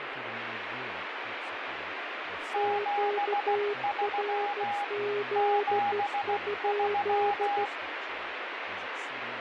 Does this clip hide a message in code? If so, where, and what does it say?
Yes: Morse code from 2.5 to 7.7 s, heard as two keyed tones, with radio static and speech in English. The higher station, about 16 wpm, 820 Hz: 73 73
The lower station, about 14 wpm, 410 Hz: QRZ?